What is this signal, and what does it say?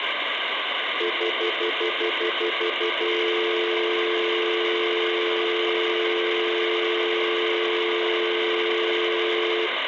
Telephone call progress tone (North American plan), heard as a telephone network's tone, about 350, 440 Hz, 0.1 s on and 0.1 s off, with phone line noise and room echo. Stutter dial tone.